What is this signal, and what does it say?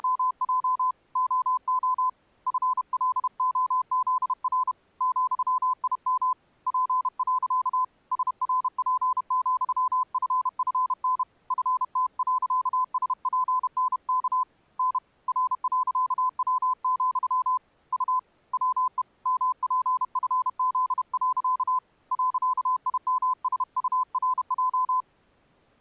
Morse code, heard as a keyed tone, hand-sent with a paddle, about 31 wpm, 1020 Hz. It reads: … OO FLOZR ,IM P. SRP,FFN FT.SPNK N R.W, U WE MPFZ. .IMSURJ